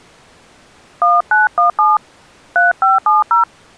DTMF, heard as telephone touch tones, dialled by hand, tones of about 160 ms. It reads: 1917 3570